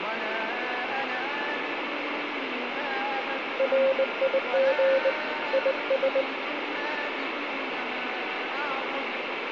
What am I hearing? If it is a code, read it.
Morse code, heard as a keyed tone, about 20 wpm, 540 Hz, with radio static, a weaker station near 1400 Hz and room echo. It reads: RIG IS